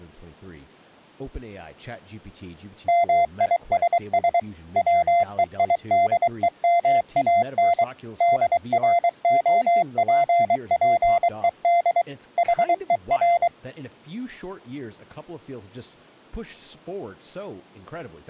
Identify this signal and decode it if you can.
Morse code, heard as a keyed tone, machine-sent, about 23 wpm, 690 Hz, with speech in English. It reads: MISS WEIDEMAN DROPPED HER